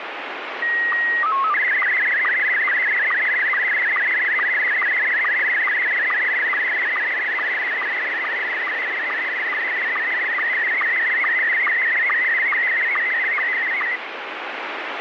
SSTV (slow-scan television), Scottie S1, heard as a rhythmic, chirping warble, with heavy radio static.